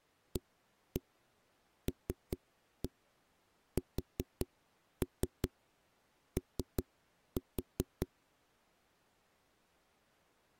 Tap code, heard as knocks on a wall, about 5 knocks a second. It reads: ALSO